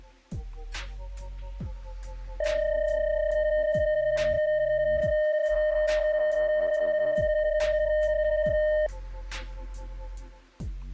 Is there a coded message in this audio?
Yes: PSK31 (31.25 baud) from 2.4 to 8.9 s, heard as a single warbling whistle, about 610 Hz.